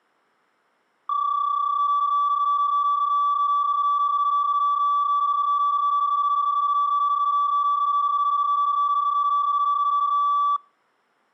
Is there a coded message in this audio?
Yes: PSK31 (31.25 baud) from 1.1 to 10.6 s, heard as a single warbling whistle, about 1150 Hz.